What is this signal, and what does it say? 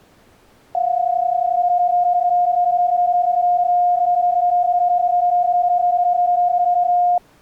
PSK31 (31.25 baud), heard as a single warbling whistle, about 710 Hz.